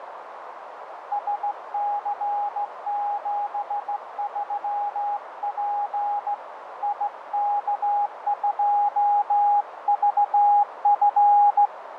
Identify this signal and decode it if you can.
Morse code, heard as a keyed tone, hand-sent with a straight key, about 16 wpm, 820 Hz, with radio static, fading and a narrow filter. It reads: SC73P IK2VF